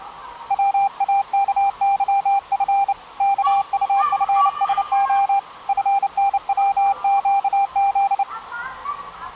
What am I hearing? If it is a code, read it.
Morse code, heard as a keyed tone, hand-sent with a bug key, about 29 wpm, 790 Hz, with the noise of a park. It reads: WAKYF KUFSO FNWQZ